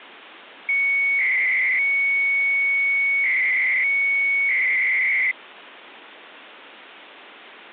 300-baud modem data (Bell 103 tones), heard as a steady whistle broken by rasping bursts, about 300 baud, 200 Hz shift.